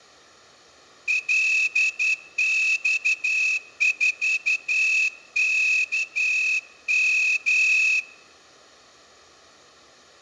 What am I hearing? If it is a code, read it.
Morse code, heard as a whistle, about 11 wpm, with room echo. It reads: LX4KM